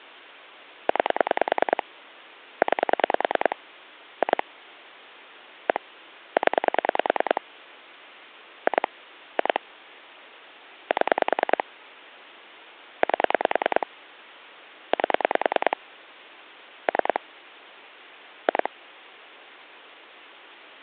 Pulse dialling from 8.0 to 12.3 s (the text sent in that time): 2 2 7